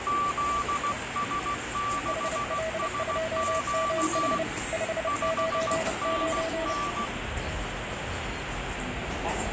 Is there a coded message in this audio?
Yes: Morse code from 0.0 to 7.1 s, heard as two keyed tones, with radio static and the noise of a subway station. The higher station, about 16 wpm, 1160 Hz: ZS6SQ 5NN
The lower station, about 30 wpm, 650 Hz: HL2MH 599